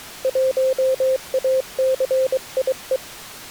Morse code, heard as a keyed tone, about 23 wpm, 520 Hz. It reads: 1ACIE